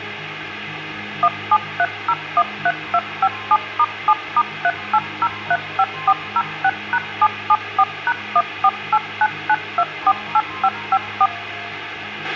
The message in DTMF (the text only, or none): 173013257*7*38035406#774#14899248554